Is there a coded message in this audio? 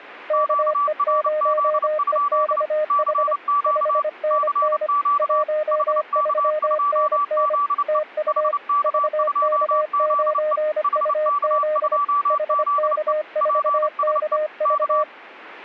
Yes: Morse code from 0.2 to 15.1 s, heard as two keyed tones. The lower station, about 25 wpm, 610 Hz: KE0EXH 5NN 13NN TU VK9UZ HK4KV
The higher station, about 29 wpm, 1160 Hz: QRZ? CQ CQ HK2ZE HK2ZE HK2ZE PSE K